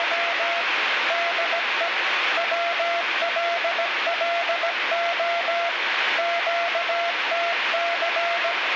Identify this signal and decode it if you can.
Morse code, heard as a keyed tone, machine-sent, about 17 wpm, 680 Hz, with heavy radio static. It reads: … DE WLLO QTC